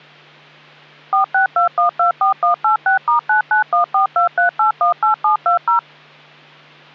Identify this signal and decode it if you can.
DTMF, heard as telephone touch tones, dialled by machine, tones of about 120 ms, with hum. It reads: 462124186*991423818720